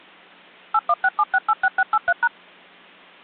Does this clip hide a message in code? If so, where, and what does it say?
Yes: DTMF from 0.7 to 2.3 s, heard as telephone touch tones, dialled by machine, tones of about 50 ms. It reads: 8167686683#